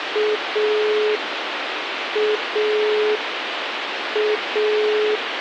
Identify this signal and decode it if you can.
Telephone call progress tone (pulsed, as in Italy), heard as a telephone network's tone, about 420 Hz, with phone line noise. Dial tone.